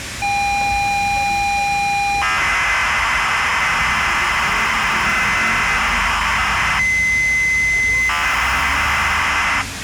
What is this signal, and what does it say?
ZX Spectrum tape loading, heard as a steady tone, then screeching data, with tape hiss and street noise.